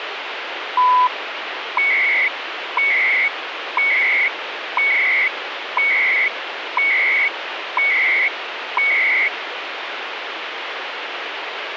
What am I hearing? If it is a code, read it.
Radio time signal (CHU, Canada), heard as beeps and data bursts, one a second, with radio static.